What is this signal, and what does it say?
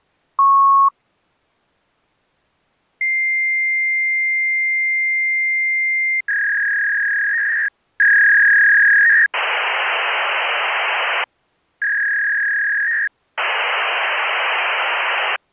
Fax machine handshake, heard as a beep, a long tone, a warble and hiss.